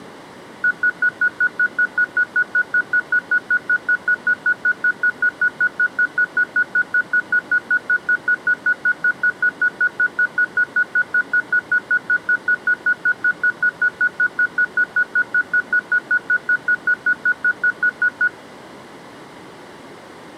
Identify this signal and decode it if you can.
Evenly repeated beeps. There is no code.